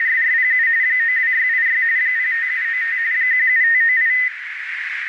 RTTY (45.45 baud, 170 Hz shift), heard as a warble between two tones, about 1950 Hz centre, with radio static and a narrow filter. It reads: … 92686 05795 17598